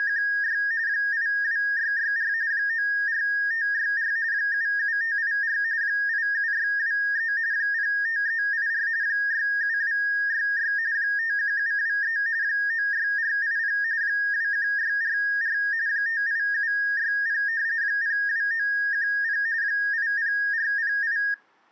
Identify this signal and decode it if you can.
RTTY (45.45 baud, 170 Hz shift), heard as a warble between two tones, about 1750 Hz centre. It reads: … 82664 94564 77584 87623 05384 67266 51723 96480 21644 58760 02910 80408